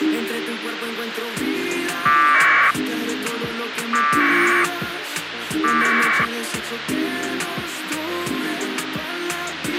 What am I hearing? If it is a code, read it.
Packet radio (AX.25, as in APRS), 1200 baud, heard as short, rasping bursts, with radio hiss and a squelch burst at the end.